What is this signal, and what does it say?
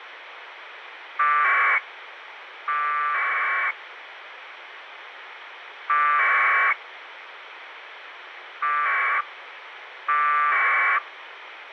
Packet radio (AX.25, as in APRS), 1200 baud, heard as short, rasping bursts, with radio hiss and a squelch burst at the end.